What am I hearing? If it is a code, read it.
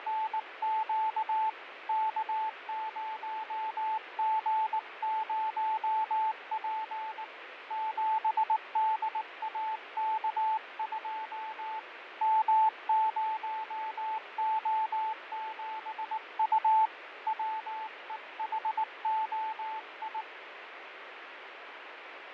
Morse code, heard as a keyed tone, hand-sent with a paddle, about 19 wpm, 880 Hz, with radio static and fading. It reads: … K0G0P 7DAK2 M0O7U WEHOI